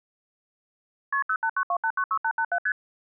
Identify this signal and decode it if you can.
Multi-frequency trunk signalling (R1, as on North American trunks), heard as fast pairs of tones, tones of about 70 ms. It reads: KP 0892896887 ST